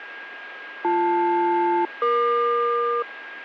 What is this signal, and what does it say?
Aircraft SELCAL, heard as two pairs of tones, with radio static and a steady whistle near 1630 Hz. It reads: BL-EQ